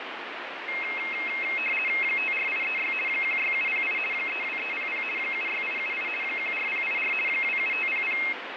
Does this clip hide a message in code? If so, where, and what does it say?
Yes: RTTY (50 baud, 450 Hz shift) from 0.7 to 8.3 s, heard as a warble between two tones, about 2350 Hz centre, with radio static. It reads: 54836 16708 32300 76878 14084 27500